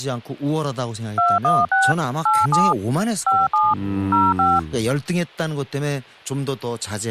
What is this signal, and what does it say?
DTMF, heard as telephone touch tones, dialled by machine, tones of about 200 ms, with speech in Korean. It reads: 216 87 57 05